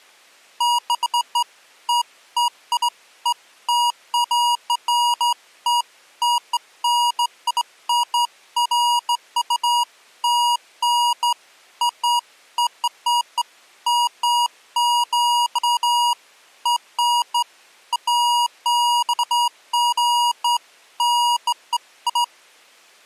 Beeps of irregular length. There is no code.